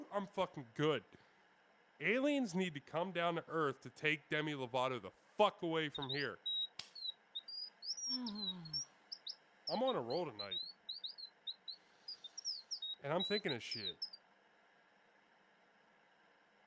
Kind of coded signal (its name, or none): none